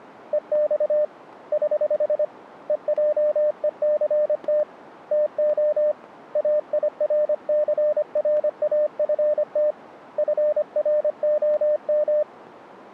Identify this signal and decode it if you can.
Morse code, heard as a keyed tone, hand-sent with a paddle, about 25 wpm, 600 Hz. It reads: EX <HH> EJECT TO AIRCRAFT FROM